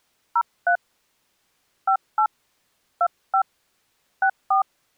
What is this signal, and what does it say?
DTMF, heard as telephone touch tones, dialled by hand, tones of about 90 ms. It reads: 03 58 25 64